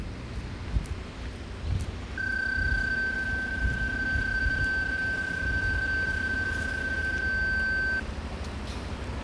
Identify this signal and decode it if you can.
PSK31 (31.25 baud), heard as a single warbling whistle, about 1550 Hz, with static crashes and the noise of a residential street.